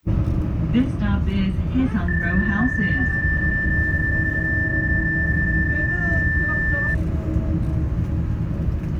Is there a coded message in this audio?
Yes: PSK31 (31.25 baud) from 2.1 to 6.9 s, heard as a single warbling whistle, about 1750 Hz, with the noise inside a bus.